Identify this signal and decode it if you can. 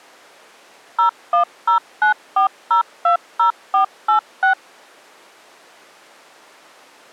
DTMF, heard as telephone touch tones, dialled by machine, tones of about 110 ms. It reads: 01094020486